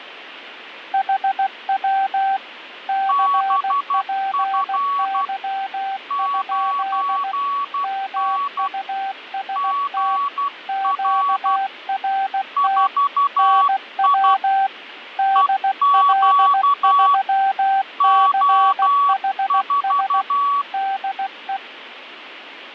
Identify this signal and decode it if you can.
Morse code, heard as two keyed tones, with radio static. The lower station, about 16 wpm, 780 Hz: HW CPY? MUST QRT NW DL3CHS DE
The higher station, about 12 wpm, 1130 Hz: BF 9N GR 4I EQ O4